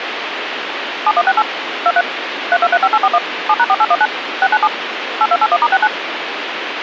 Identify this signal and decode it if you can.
DTMF, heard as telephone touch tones, dialled by machine, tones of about 50 ms, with radio hiss. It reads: 7168 23 3235841 7#4819 697 8281*69